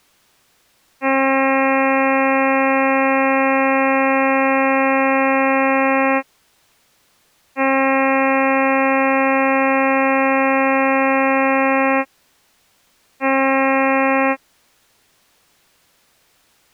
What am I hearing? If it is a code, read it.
Ship horn signal, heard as a ship's horn, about 270 Hz. 2 long, 1 short. At sea: I intend to overtake on your starboard side.